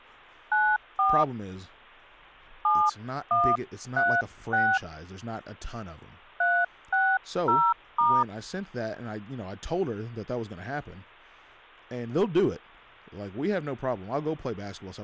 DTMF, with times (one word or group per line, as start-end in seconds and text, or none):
0.5-1.2 94
2.6-4.8 7136
6.4-8.2 360*